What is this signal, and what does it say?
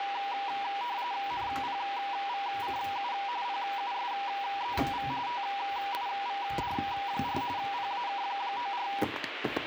RTTY (45.45 baud, 170 Hz shift), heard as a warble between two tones, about 880 Hz centre, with radio static and kitchen noise. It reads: NPVCU PUSEV TIVD4 PAK94